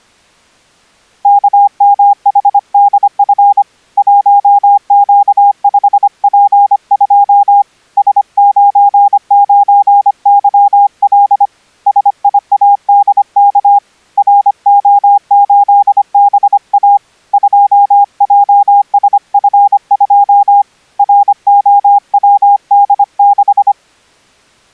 Morse code, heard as a keyed tone, hand-sent with a paddle, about 25 wpm, 810 Hz. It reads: KMHDF 1Q5P2 S99YL SIADK RO8BA 2JSF2 ROWD6